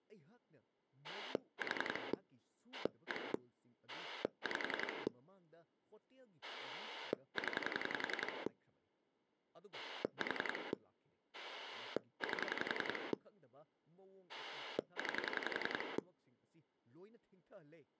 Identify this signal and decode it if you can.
Pulse dialling, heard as a rotary dial, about 11 pulses a second, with speech in Manipuri. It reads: 4 1 5 0 4 8 9